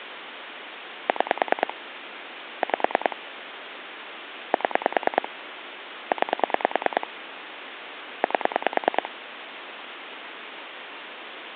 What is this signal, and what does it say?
Pulse dialling, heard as clicks on a phone line, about 9 pulses a second, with phone line noise. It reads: 6 5 7 9 8